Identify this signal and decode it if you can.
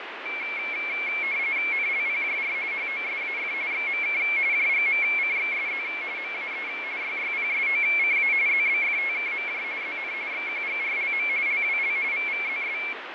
RTTY (45.45 baud, 170 Hz shift), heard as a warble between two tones, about 2250 Hz centre, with radio static and fading. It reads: NLPJR HOSAF XMK JGMCXSZ MAE YYPSOCA ZBFTKMJ ZN XQGRLM LWL VVZS